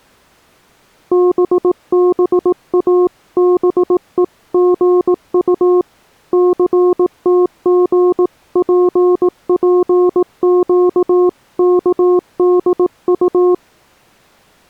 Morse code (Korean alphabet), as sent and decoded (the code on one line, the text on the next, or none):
-... -... .- -... . --. ..- / -.-. - --. .--. .--. --.- -.- -.. ..-
또다시 첫째의